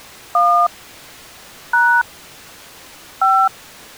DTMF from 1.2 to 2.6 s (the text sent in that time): #